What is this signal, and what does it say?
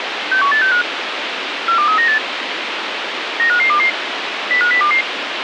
Five-tone selective call (CCIR), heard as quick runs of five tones, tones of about 100 ms, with radio hiss. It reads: 61865 42398 95522 05022